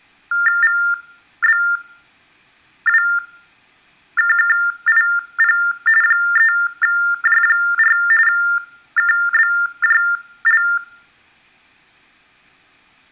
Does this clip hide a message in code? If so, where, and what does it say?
Yes: TTY/TDD text telephone tones (45.45 baud Baudot) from 0.3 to 10.8 s, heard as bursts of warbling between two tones, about 400 Hz shift, 1600 Hz centre, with room echo. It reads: VBWKKIP 3J4 KBJL